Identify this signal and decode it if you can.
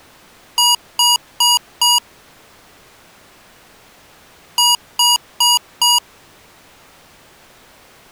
Beep code, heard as beeps from a small speaker, played twice, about 960 Hz. 4 short. In AMI BIOS tables: system timer failure; in Dell tables: memory read or write failure.